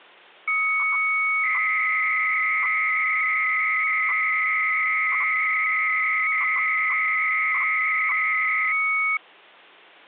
300-baud modem data (Bell 103 tones), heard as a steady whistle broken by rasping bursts, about 300 baud, 200 Hz shift.